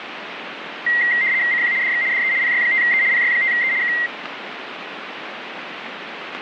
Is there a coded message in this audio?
Yes: RTTY (75 baud, 170 Hz shift) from 0.9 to 4.1 s, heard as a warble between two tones, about 2000 Hz centre, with radio static. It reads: CQ DX DE PY5E PY5E K